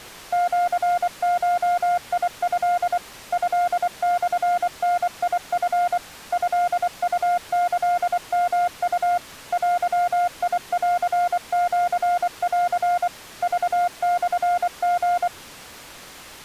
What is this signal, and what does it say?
Morse code (Japanese Wabun code), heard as a keyed tone, machine-sent, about 24 wpm, 710 Hz. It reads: シゴト トモダチ トウキヨウ デンシン クモリ